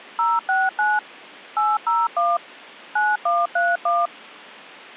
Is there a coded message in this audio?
Yes: DTMF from 0.2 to 4.1 s, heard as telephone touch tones, dialled by machine, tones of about 200 ms. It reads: 069 801 9131